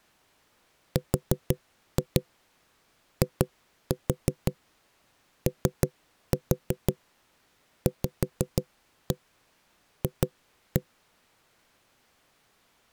Tap code, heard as knocks on wood, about 6 knocks a second. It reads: RIOVF